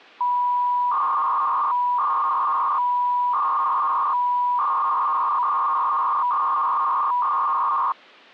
300-baud modem data (V.21 tones), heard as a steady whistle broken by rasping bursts, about 300 baud, 200 Hz shift.